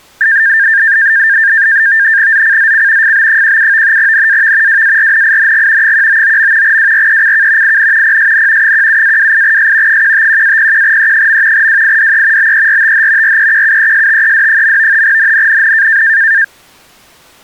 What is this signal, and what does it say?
NAVTEX (SITOR-B), 100 baud, 170 Hz shift, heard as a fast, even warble, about 1700 Hz centre. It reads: ZCZC FB17 NAV WARNING 199. WRECK IN PSN 17-28S 151-01E. WIDE BERTH REQUESTED. NNNN